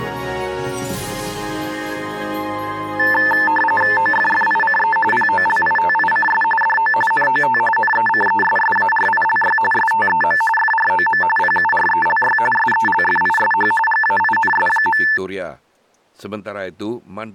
RTTY (45.45 baud, 850 Hz shift), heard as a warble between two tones, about 1320 Hz centre. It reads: OFFICE POLITICS DO NOT NECESSARILY STEM FROM PURELY SELFISH GAINS.